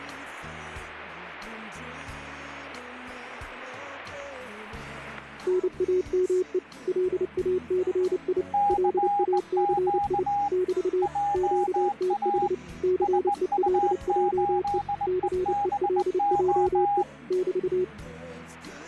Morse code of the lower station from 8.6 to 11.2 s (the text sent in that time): LACI <BT>